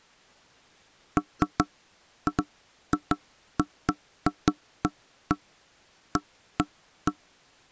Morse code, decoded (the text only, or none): none